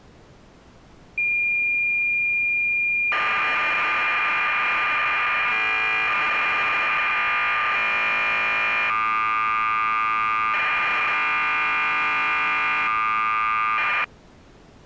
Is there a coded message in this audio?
Yes: cassette data (Kansas City type), 1200 baud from 1.2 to 14.0 s, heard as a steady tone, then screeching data.